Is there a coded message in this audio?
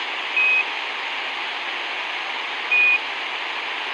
Yes: Quindar tones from 0.4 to 3.0 s, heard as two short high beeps, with radio hiss.